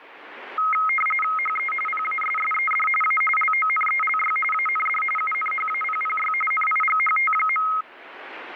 RTTY (45.45 baud, 850 Hz shift), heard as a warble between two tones, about 1700 Hz centre, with radio static. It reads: HE PASSED A LONELY AND UNHAPPY NIGHT.